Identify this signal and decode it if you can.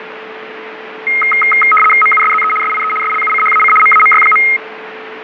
RTTY (75 baud, 850 Hz shift), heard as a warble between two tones, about 1700 Hz centre, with radio static, fading and a steady whistle near 440 Hz. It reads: MUSZE SIE SLUCHAC MAMY.